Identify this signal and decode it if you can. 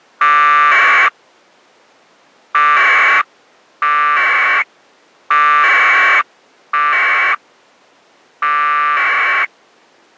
Packet radio (AX.25, as in APRS), 1200 baud, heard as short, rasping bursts.